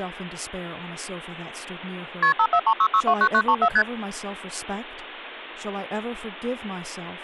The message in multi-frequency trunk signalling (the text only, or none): KP 5436629934 ST